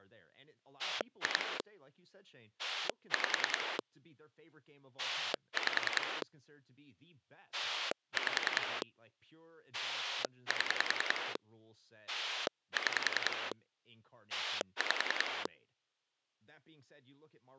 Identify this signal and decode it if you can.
Pulse dialling, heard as a rotary dial, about 10 pulses a second, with speech in English. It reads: 2 5 5 5 7 6 5